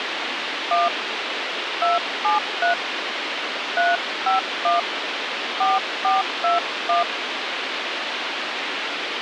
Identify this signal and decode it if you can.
DTMF, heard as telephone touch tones, dialled by hand, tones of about 160 ms, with radio hiss. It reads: 1 273 351 4421